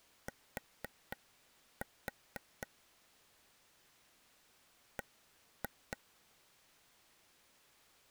Tap code, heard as taps on a table, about 4 knocks a second. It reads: T B